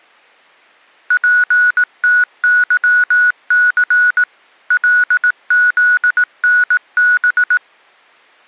Morse code, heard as electronic beeps, machine-sent, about 18 wpm, 1470 Hz. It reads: PTYC LZNB